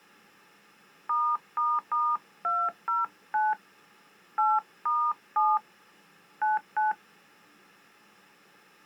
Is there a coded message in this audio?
Yes: DTMF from 1.1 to 6.9 s, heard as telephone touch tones, dialled by hand, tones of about 190 ms. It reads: ***209 8*7 99